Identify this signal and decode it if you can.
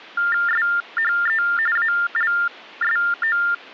TTY/TDD text telephone tones (45.45 baud Baudot), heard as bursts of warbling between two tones, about 400 Hz shift, 1600 Hz centre. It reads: SHE ALSO